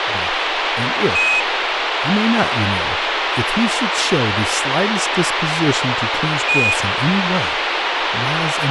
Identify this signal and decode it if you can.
Quindar tones, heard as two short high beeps, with radio hiss and speech in English.